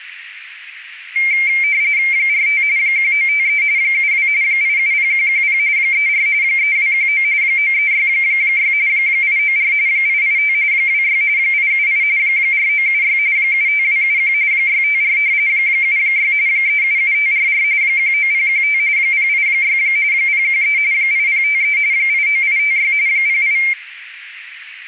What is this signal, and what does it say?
RTTY (45.45 baud, 170 Hz shift), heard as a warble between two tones, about 2200 Hz centre, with radio static. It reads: 45 1953 72 870110 34 3219 9366 894 885 26 878 4976 75271 654 76 377544 19015 086 013 8053 89856 08